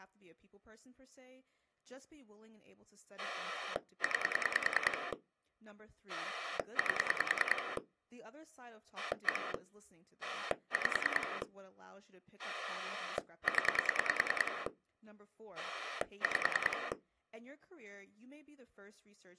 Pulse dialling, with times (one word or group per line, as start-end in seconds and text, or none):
3.2-5.1 9
6.1-7.8 8
9.0-9.5 1
10.2-11.4 5
12.4-14.7 0
15.6-16.9 5